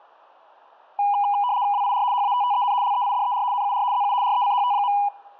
RTTY (75 baud, 170 Hz shift), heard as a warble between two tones, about 900 Hz centre. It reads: WIR HATTEN LEIDER NUR ZU RECHT.